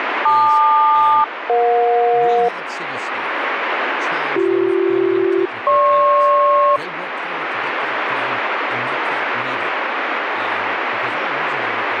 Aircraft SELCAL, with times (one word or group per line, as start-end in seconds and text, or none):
0.3-2.5 LQ-EJ
4.4-6.8 BC-GP